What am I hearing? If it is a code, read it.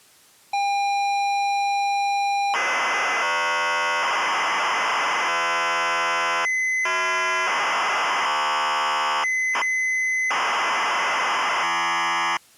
ZX Spectrum tape loading, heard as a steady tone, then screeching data.